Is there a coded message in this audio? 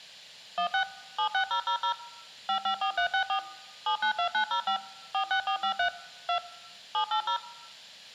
Yes: DTMF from 0.6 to 7.4 s, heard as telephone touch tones, dialled by machine, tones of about 90 ms. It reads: 16 76000 554364 792905 46453 2 780